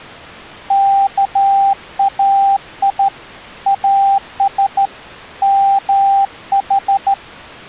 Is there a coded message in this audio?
Yes: Morse code (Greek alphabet) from 0.6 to 7.2 s, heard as a keyed tone, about 13 wpm, 790 Hz. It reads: ΚΑΙ ΑΣ ΜΗ